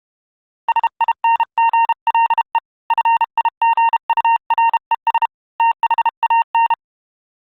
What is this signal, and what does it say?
Morse code, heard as a keyed tone, hand-sent with a paddle, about 32 wpm, 920 Hz. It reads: SINGLE FIGURES THAN